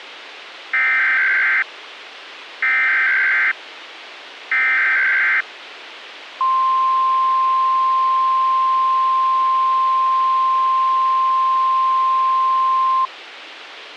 Emergency Alert System (SAME) tones (header bursts, then the 1050 Hz attention tone), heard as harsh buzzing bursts, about 520.83 baud, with radio hiss.